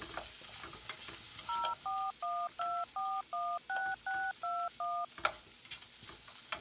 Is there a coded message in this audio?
Yes: DTMF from 1.5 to 5.0 s, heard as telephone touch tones, dialled by machine, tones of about 250 ms, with kitchen noise. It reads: 0412416621